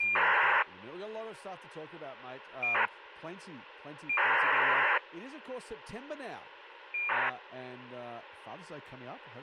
ACARS aircraft data, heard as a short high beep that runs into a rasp, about 2400 baud, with radio hiss, a squelch burst at the end and speech in English.